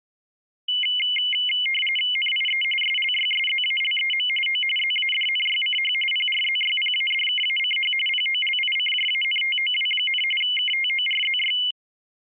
RTTY (45.45 baud, 850 Hz shift), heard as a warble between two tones, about 2550 Hz centre. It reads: NIE SLYSZALEM O ZADNYCH PRZYPADKACH POLICJANTOW, KTORZY